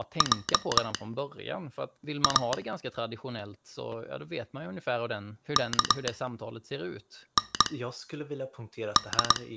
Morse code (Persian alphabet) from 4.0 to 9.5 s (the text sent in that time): کند